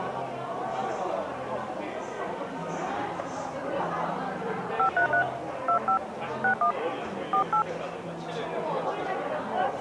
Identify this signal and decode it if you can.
DTMF, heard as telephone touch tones, dialled by hand, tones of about 100 ms, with the noise of a cafe. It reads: 533 25 61 48